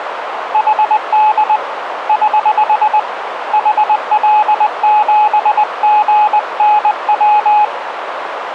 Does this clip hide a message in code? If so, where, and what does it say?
Yes: Morse code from 0.5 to 7.7 s, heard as a keyed tone, hand-sent with a paddle, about 20 wpm, 850 Hz, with radio static and a narrow filter. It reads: HD <HH> HL7GNW